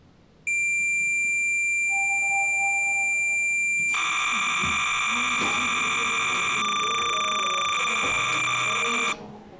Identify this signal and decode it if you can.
Cassette data (Kansas City type), 300 baud, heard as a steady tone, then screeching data, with the noise inside a lift.